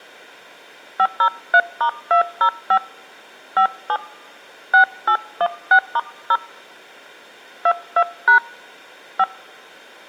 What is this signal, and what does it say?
DTMF, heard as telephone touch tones, dialled by hand, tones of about 80 ms. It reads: 503*205 57 6816*0 22# 5